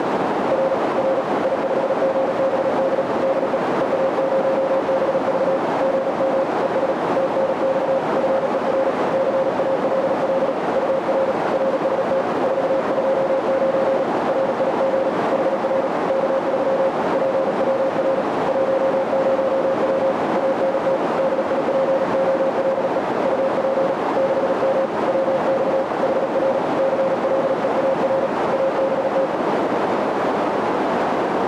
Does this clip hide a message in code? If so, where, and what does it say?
Yes: Morse code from 0.5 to 29.3 s, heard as a keyed tone, hand-sent with a paddle, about 37 wpm, 540 Hz, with heavy radio static and a narrow filter. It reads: R R I5GBD DE EA0BV GM ES TNX FER CALL UR RST 429 RIG HR K3 PWR 10W ANT DIPOLE UP 6M WX HR CLEAR ABT